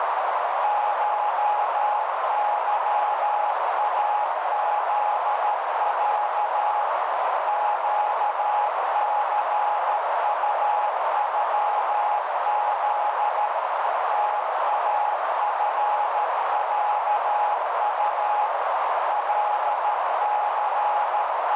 Morse code (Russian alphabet), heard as a keyed tone, machine-sent, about 13 wpm, 840 Hz, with heavy radio static and a narrow filter. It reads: ШЫАЗЯ ЩЦУЮЗ ТАФЯУ …